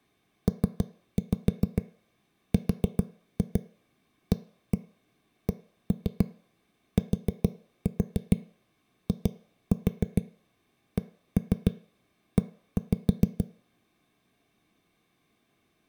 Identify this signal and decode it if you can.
Tap code, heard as knocks on a wall, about 6 knocks a second. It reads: PRACTICE